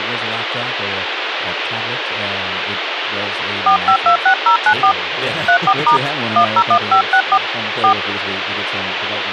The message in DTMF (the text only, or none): 4526094 34* 101564 4